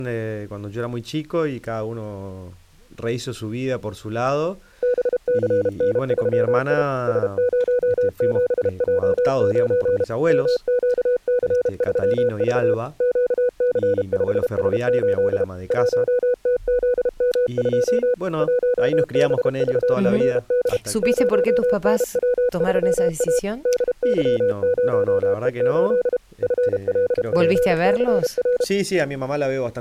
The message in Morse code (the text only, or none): BCN3I S07J9 MQC3V QC5S8 1TZM2 1BVFD 0NW3A DY0E8 FLPCR